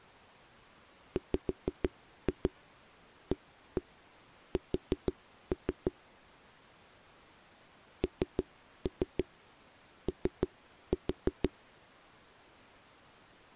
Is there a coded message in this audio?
Yes: tap code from 1.2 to 11.5 s, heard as knocks on a wall, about 6 knocks a second. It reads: WAS NO